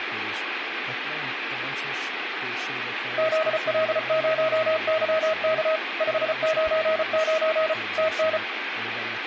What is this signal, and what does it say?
Morse code, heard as a keyed tone, machine-sent, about 34 wpm, 640 Hz, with radio static and speech in Hungarian. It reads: ZL0YK 599 TN